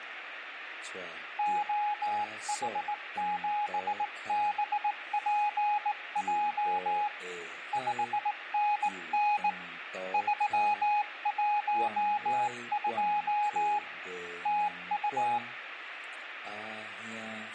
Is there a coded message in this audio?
Yes: Morse code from 1.3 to 15.4 s, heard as a keyed tone, hand-sent with a straight key, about 18 wpm, 830 Hz, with radio static and fading. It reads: OH7BPJ 5NN 312 TU